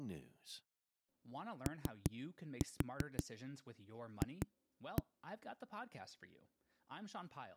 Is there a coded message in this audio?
Yes: tap code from 1.7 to 5.0 s, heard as knocks on a wall, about 5 knocks a second, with speech in English. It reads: OF